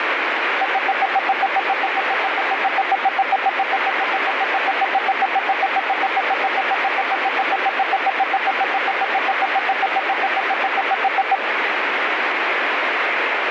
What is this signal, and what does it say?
Evenly repeated beeps, with heavy radio static. There is no code.